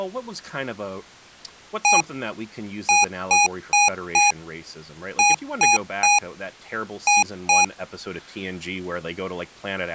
Beep code, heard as beeps from a small speaker, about 820 Hz, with speech in English. 1-4-3-2.